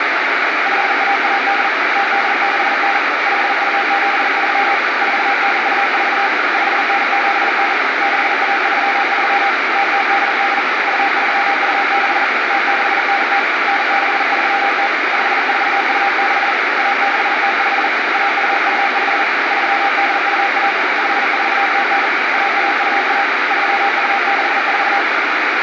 Morse code (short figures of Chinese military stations), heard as a keyed tone, hand-sent with a paddle, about 40 wpm, 800 Hz, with heavy radio static. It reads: 5118 0869 5273 4924 5979 6133 0088 2326 0690 9630 5426 1605 1225 3821 5409 1121 3264